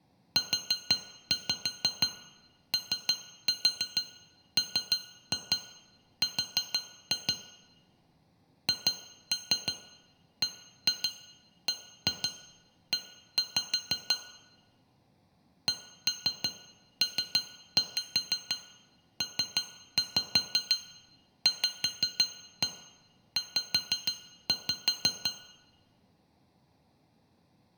Tap code, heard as taps on glass, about 6 knocks a second, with room echo. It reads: UOMR HBBE CPPVZ